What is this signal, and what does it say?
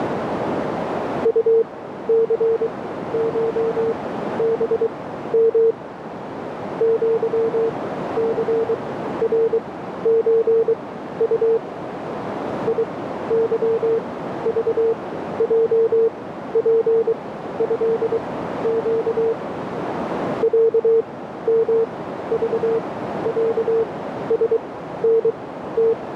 Morse code (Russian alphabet), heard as a keyed tone, machine-sent, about 23 wpm, spaced as for 13 wpm, 450 Hz, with radio static and a narrow filter. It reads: УЦШБМ ЪЦРЧУ ИЫЖЙПЭЩ ЯМЖЯСНТ